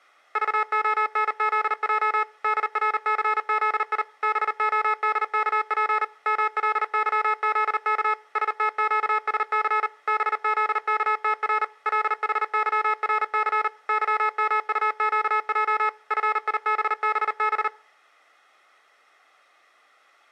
Morse code, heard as electronic beeps, machine-sent, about 39 wpm, 430 Hz, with room echo. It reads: VONZJ DRCZI BODKP MLYZK STQSC BZKTR LHYRC YMUQJ FIBBB